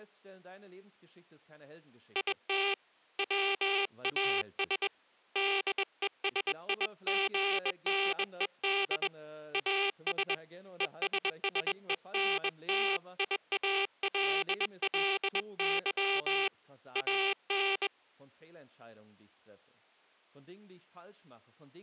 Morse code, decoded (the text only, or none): IT WAS DESIGNED AS ESSENTIALLY AN